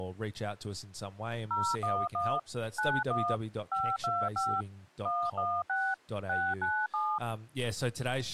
DTMF, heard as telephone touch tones, dialled by machine, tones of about 250 ms, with speech in English. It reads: 011 91 525 116 697